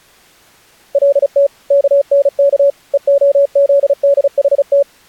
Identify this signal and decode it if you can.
Morse code, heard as a keyed tone, machine-sent, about 35 wpm, 560 Hz. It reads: LT KNK EOZDHT